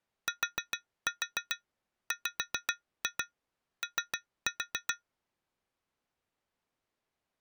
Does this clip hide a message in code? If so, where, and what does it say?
Yes: tap code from 0.3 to 5.0 s, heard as taps on glass, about 7 knocks a second. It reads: TWO